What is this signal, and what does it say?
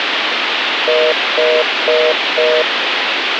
Telephone call progress tone (North American plan), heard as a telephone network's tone, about 480, 620 Hz, 0.25 s on and 0.25 s off, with phone line noise. Congestion tone.